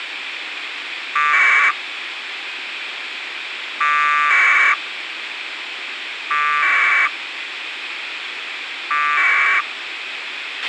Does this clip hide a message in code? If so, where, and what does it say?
Yes: packet radio (AX.25, as in APRS), 1200 baud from 1.2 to 9.6 s, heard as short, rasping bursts, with radio hiss and a squelch burst at the end.